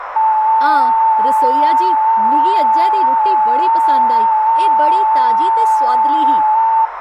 FT8 (one signal), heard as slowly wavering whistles, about 6.25 baud, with radio static, a narrow filter, room echo and speech in Dogri.